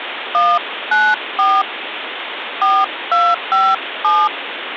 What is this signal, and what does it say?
DTMF, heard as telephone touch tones, dialled by hand, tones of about 230 ms, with phone line noise. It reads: 194 4257